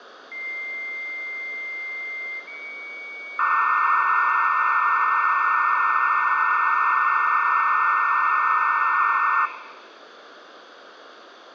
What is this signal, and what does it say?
Dial-up modem handshake (low-speed, two carriers), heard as two whistles, then hiss, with phone line noise and room echo.